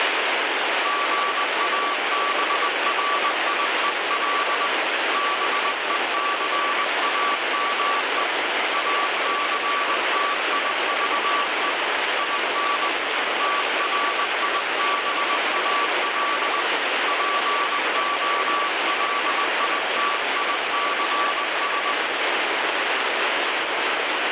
Morse code, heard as a keyed tone, hand-sent with a paddle, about 20 wpm, 1150 Hz, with heavy radio static. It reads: GABRIEL BECAME ACTIVE IN TRIBAL POLITICS